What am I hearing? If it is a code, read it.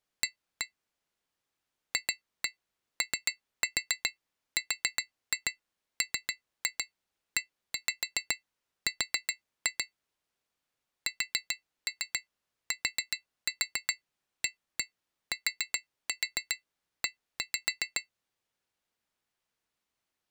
Tap code, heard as taps on glass, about 7 knocks a second. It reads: A FORMER STATE